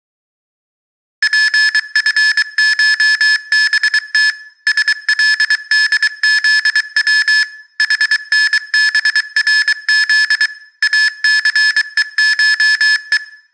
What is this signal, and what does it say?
Morse code (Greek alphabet), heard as electronic beeps, machine-sent, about 23 wpm, 1700 Hz, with room echo. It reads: ΠΦΧΒΤ ΣΛΔΖΩ ΗΝΒΡΖ ΑΘΕΧΕ